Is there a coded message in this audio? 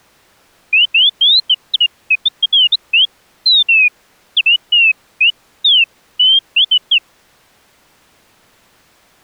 No, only bird-like chirps.